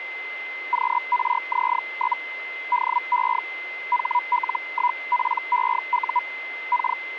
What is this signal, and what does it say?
Hellschreiber (Feld-Hell, 122.5 baud), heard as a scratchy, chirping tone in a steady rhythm, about 980 Hz, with radio static and a steady whistle near 2060 Hz. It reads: QRZ? DE HL1PEU K